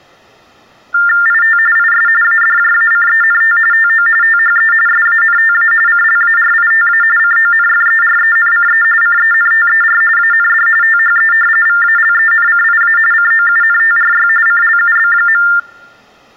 TTY/TDD text telephone tones (45.45 baud Baudot), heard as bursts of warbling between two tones, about 400 Hz shift, 1600 Hz centre. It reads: IT IS ADJACENT TO THE SANTA CLARITA CONFERENCE CENTER AND THE VALENCIA COUNTRY CLUB.